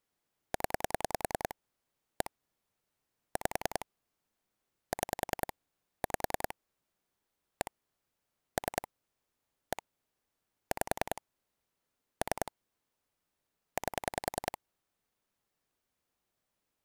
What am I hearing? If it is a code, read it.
Pulse dialling, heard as clicks on a phone line, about 10 pulses a second. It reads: 0 1 5 6 5 1 3 1 5 3 8